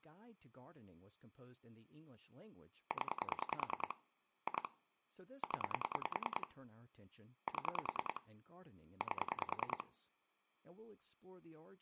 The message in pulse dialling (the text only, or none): 0 2 0 7 8